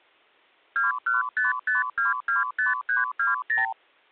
Multi-frequency trunk signalling (R2, with the far end's replies), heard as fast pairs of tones, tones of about 150 ms. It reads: 2155225320